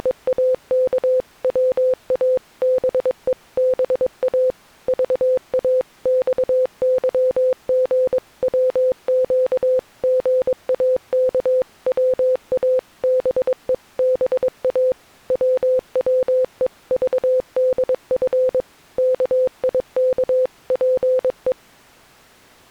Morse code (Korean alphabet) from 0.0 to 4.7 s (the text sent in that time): …